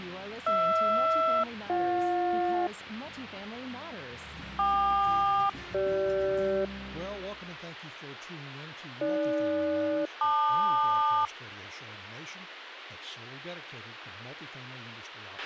Aircraft SELCAL, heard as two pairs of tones, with a squelch burst at the end. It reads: HR-BJ KQ-CG AG-LQ